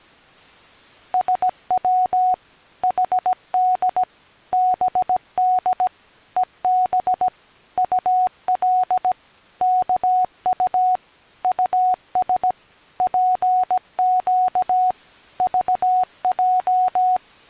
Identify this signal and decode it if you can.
Morse code, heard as a keyed tone, machine-sent, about 17 wpm, 740 Hz. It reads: SW HD BD EB UL KU US PQ VJ